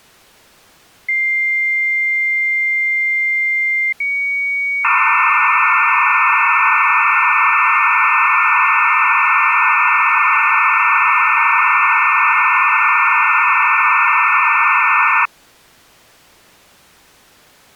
Dial-up modem handshake (low-speed, two carriers), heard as two whistles, then hiss.